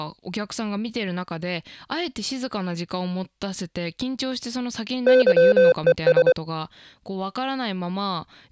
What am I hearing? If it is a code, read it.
Morse code, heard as electronic beeps, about 24 wpm, 510 Hz, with speech in Japanese. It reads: YES